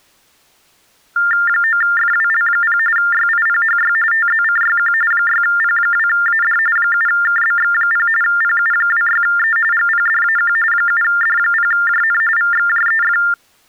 TTY/TDD text telephone tones (45.45 baud Baudot), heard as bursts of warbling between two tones, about 400 Hz shift, 1600 Hz centre. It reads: 9FWL0 YIPHY TZCYQ 6P2AD 7KBX0 PU26E GPDAQ 7D0JN VXJEF